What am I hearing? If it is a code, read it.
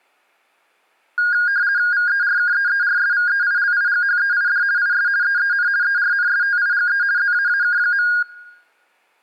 RTTY (50 baud, 170 Hz shift), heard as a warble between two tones, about 1550 Hz centre, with room echo. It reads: VERKEERSVEILIGHEID IS EEN ERNSTIGE ZAAK.